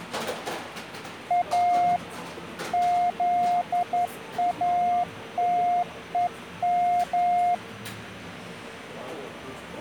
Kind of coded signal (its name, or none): Morse code